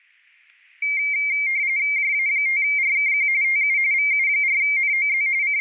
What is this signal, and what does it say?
RTTY (45.45 baud, 170 Hz shift), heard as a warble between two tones, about 2200 Hz centre. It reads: JA5RKQ TU VU4NOZ …